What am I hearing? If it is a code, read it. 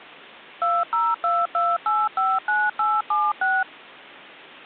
DTMF, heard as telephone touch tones, dialled by machine, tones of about 220 ms. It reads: 2022859876